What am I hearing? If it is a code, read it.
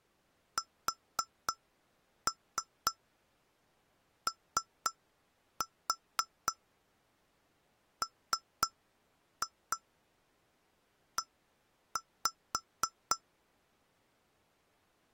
Tap code, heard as taps on glass, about 3 knocks a second. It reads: SOME